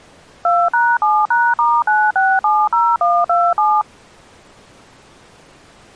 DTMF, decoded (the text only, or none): 2#7#*9670127